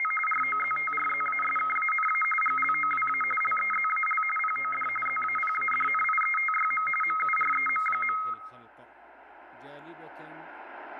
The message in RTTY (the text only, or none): … ROZTRZASKANA GLOWA LEZAL POD ZAPADNIETYM MUREM.